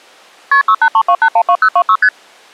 Multi-frequency trunk signalling (R1, as on North American trunks), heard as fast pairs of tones, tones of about 70 ms. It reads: KP 6832812026 ST